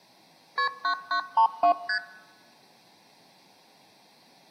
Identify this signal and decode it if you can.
Multi-frequency trunk signalling (R1, as on North American trunks), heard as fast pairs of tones, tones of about 90 ms. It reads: KP 9932 ST